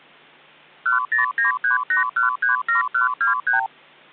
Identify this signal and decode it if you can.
Multi-frequency trunk signalling (R2, with the far end's replies), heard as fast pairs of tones, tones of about 130 ms. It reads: 10938137123